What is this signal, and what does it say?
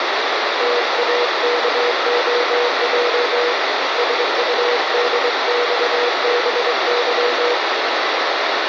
Morse code (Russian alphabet), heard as a keyed tone, hand-sent with a straight key, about 23 wpm, 480 Hz, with heavy radio static. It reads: ТАКОЙ СУДЬБЫ